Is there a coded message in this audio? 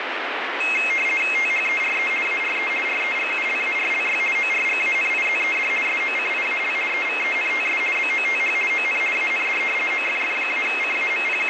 Yes: RTTY (50 baud, 450 Hz shift) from 0.6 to 11.5 s, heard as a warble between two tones, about 2350 Hz centre, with radio static. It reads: THERE ARE REGULARLY ORGANIZED SOCIAL EVENTS BOTH ON AND …